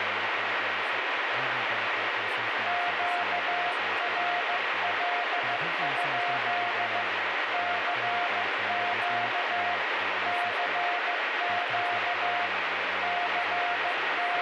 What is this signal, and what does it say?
Morse code, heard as a keyed tone, hand-sent with a paddle, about 15 wpm, 710 Hz, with heavy radio static and speech in English. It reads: QRL? CQ CQ …